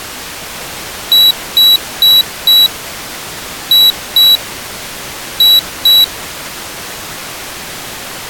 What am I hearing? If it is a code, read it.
Beep code, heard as a piezo beeper, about 3900 Hz. 4-2-2. In Phoenix BIOS tables: shutdown test failure.